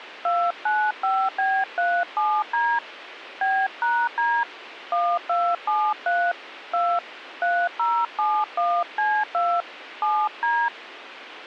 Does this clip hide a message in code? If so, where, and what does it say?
Yes: DTMF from 0.2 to 10.7 s, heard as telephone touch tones, dialled by hand, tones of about 260 ms, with radio hiss. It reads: 295B37D B#D 1273 2 3071C2 7D